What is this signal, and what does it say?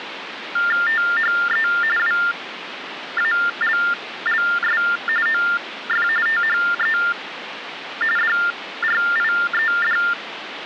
TTY/TDD text telephone tones (45.45 baud Baudot), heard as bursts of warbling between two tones, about 400 Hz shift, 1600 Hz centre, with phone line noise. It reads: THE WALLS OF THE DRIED